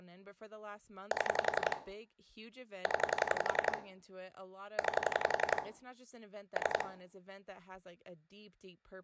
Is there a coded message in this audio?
Yes: pulse dialling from 1.1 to 6.8 s, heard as clicks on a phone line, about 11 pulses a second, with room echo and speech in English. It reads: 7 0 9 3